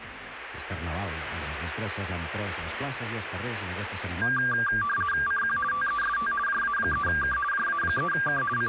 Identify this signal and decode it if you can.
RTTY (50 baud, 450 Hz shift), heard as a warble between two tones, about 1380 Hz centre, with radio static. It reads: CQ TEST JA3K JA3K …